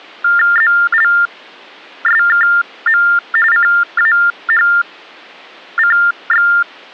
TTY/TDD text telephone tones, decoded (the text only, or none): ZLSKM CAHCX